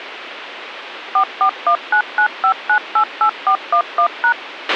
DTMF, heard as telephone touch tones, dialled by machine, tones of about 80 ms, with radio hiss and a squelch burst at the end. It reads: 441995988411#